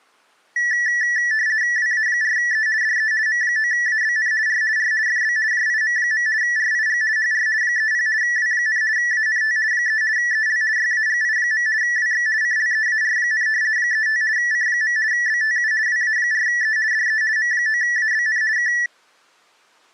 RTTY (50 baud, 170 Hz shift), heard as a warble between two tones, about 1850 Hz centre. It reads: WA4E DE M9ABN R R FB JIM. RIG HR 30 W, ANT 3 EL YAGI. WX CLEAR, 35 C. BTU WA4E DE M9ABN K